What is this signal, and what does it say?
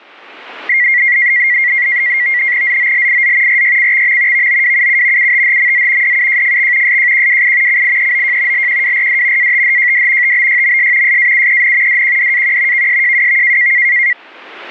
NAVTEX (SITOR-B), 100 baud, 170 Hz shift, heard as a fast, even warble, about 2050 Hz centre. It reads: ZOLIZ RYCXM VOWUU UTHMZ DUJFX SJQWI CIEOJ LQWRD ATHJD TBYMS SAUEN DQDAQ KSJWV